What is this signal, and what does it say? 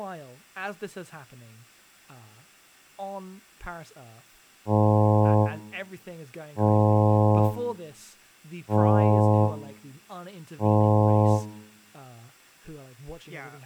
Ship horn signal, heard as a ship's horn, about 110 Hz, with room echo and speech in English. 4 short. At sea: a pilot vessel's identity signal in fog.